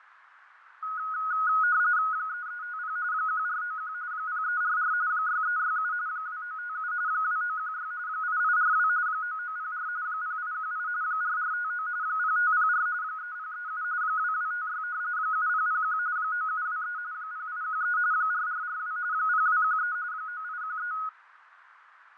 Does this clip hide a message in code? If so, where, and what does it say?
Yes: RTTY (45.45 baud, 170 Hz shift) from 0.8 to 21.1 s, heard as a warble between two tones, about 1360 Hz centre, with radio static, fading and a narrow filter. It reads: 3350 1491 0344 6367 2957 2916 8842 9904 0818 4459 0504 3037 2256 7001 9723 0813 4442 0213 9813